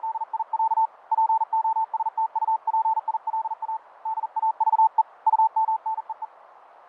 Morse code (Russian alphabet), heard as a keyed tone, hand-sent with a paddle, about 40 wpm, 890 Hz, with radio static, fading and a narrow filter. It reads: … ПОСТУПИЛА ДАЖЕ УМНЕЕ